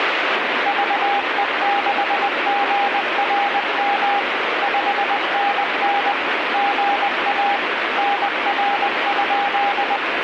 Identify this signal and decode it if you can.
Morse code, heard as a keyed tone, machine-sent, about 20 wpm, 810 Hz, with radio static. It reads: VE6GRM 5NN GA NR?